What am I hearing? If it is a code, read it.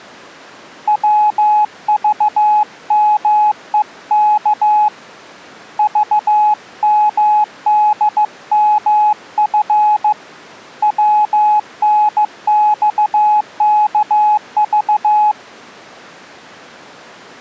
Morse code, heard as a keyed tone, hand-sent with a paddle, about 15 wpm, 840 Hz. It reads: WVMEK VMDMF WNXKV